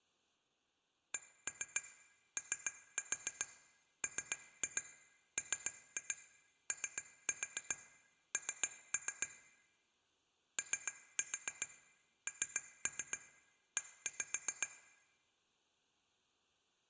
Tap code, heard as taps on glass, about 7 knocks a second, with room echo. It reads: COMMON ONE